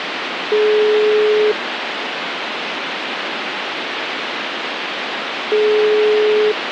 Telephone call progress tone (single-tone plan, as in most of Europe), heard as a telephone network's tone, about 420 Hz, 1 s on and 4 s off, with phone line noise. Ringback tone.